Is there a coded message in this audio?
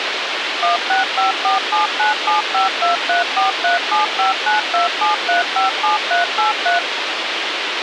Yes: DTMF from 0.6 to 6.8 s, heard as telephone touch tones, dialled by machine, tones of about 140 ms, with radio hiss. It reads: 16547975234375927357383